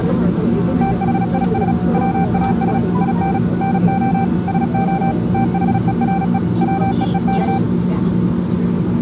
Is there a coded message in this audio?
Yes: Morse code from 0.8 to 7.6 s, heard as a keyed tone, machine-sent, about 36 wpm, 780 Hz, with the noise inside a subway train. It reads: THIS WAS IN NO SO THERE WEEK